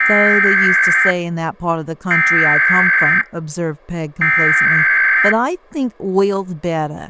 Emergency Alert System (SAME) tones (header bursts), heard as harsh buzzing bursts, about 520.83 baud, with speech in English.